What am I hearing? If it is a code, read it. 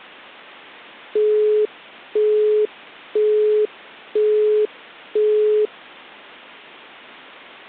Telephone call progress tone (single-tone plan, as in Europe, Japan and elsewhere), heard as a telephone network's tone, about 420 Hz, 0.5 s on and 0.5 s off. Busy tone.